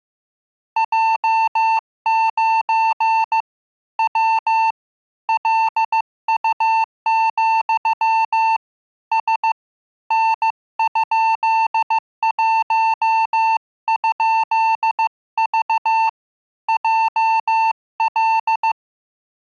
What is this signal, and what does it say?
Morse code, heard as a keyed tone, hand-sent with a paddle, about 15 wpm, 890 Hz. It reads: J9 W LU, S N?1?V JL